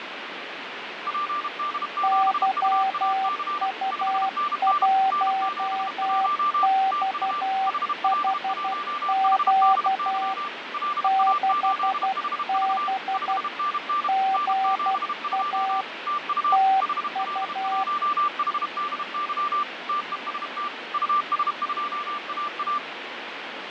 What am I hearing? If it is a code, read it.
Morse code, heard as two keyed tones, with radio static and fading. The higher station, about 32 wpm, 1180 Hz: PD7UAC 5NN N71 TU HL1HDY LA8HV 5NN N72 TU HL1HDY TEST US2AA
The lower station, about 12 wpm, 770 Hz: YU1XHQ 6B GA TU